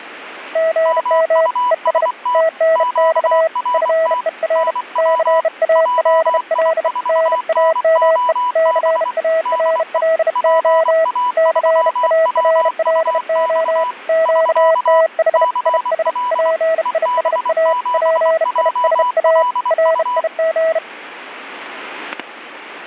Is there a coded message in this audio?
Yes: Morse code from 0.5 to 20.8 s, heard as two keyed tones, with static crashes. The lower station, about 32 wpm, 650 Hz: GM ES TNX FER CALL NAME CARLO CARLO QTH IS PISA PISA RIG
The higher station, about 24 wpm, 990 Hz: MUST QRT NW JI4NOB DE PA3WUX <SK> CL EB7JLU